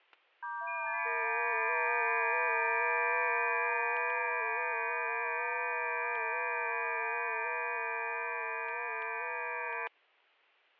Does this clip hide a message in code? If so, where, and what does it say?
Yes: FT8 (several signals at once) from 0.4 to 9.9 s, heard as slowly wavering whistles, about 6.25 baud, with static crashes.